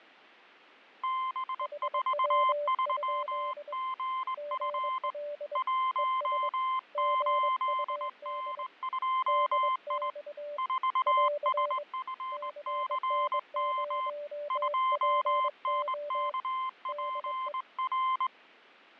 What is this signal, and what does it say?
Morse code, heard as two keyed tones, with fading. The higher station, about 20 wpm, 1040 Hz: B43GF 18N2I 4SFCM 2NKPR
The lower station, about 22 wpm, 590 Hz: HW? GL ES GUD DX <AR> CN0PO DE